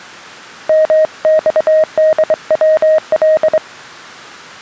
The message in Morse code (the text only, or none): MXDWL